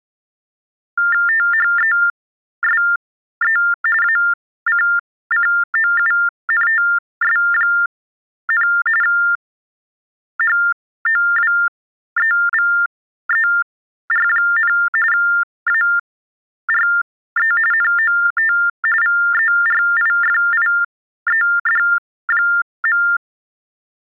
TTY/TDD text telephone tones (45.45 baud Baudot), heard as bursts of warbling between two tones, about 400 Hz shift, 1600 Hz centre. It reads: THESE ACCOUNTS, HOWEVER, ARE NOT VERIFIED.